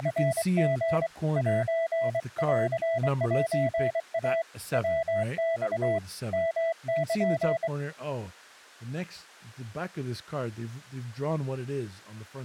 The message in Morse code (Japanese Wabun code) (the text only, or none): … センセイ ヤマ ヨル